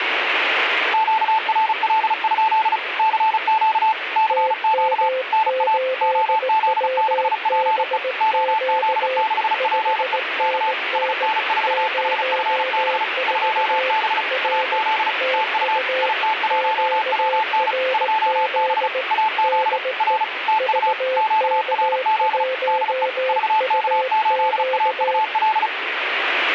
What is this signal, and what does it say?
Morse code, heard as two keyed tones, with radio static. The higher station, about 35 wpm, 880 Hz: QRL? CQ CQ NA OZ6PE OZ6PE K SN4HFB 2B AZ TU IT1WN 2B AZ R TU QRZ DE VK8AUL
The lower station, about 18 wpm, 520 Hz: TM8WBQ 5NN 04 R TU QRZ DE VK1UQ